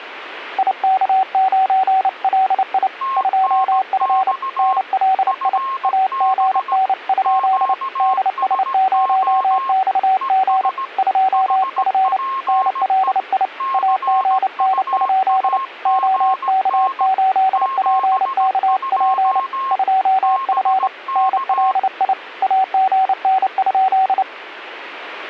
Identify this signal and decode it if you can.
Morse code, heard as two keyed tones. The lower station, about 29 wpm, 760 Hz: IK9LI 2F NLI AGN? DS0XG 2F NLI AGN? OK8PKP 2F NLI AGN?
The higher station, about 17 wpm, 1070 Hz: TNX FB QSO ES HPE CUAGN 72 BK